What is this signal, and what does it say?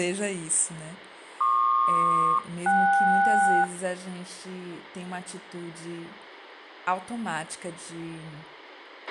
Aircraft SELCAL, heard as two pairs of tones, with a squelch burst at the end and speech in Portuguese. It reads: PQ-KS